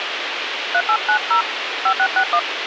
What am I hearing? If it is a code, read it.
DTMF, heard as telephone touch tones, dialled by hand, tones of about 70 ms, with radio hiss and a squelch burst at the end. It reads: 3890 5661